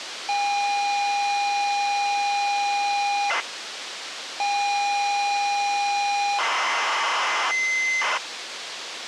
ZX Spectrum tape loading, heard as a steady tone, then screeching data, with tape hiss.